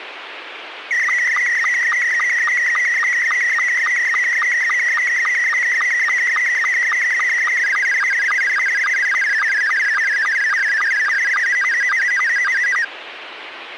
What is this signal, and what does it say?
SSTV (slow-scan television), Scottie S2, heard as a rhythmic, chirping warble, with radio hiss.